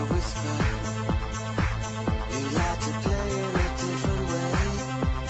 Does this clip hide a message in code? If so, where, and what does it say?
No.